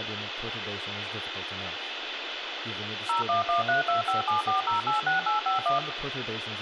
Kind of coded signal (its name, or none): DTMF